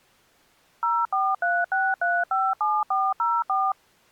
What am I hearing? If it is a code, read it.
DTMF, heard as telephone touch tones, dialled by machine, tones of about 220 ms. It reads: 0436357404